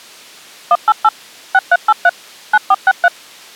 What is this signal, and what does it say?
DTMF, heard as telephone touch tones, dialled by machine, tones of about 40 ms. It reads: 188 6383 9463